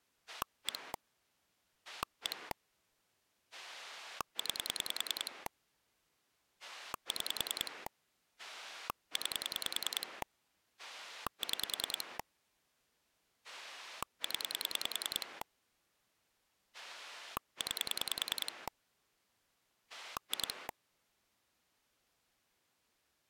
Pulse dialling, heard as a rotary dial, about 10 pulses a second. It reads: 1 1 9 6 9 6 0 9 2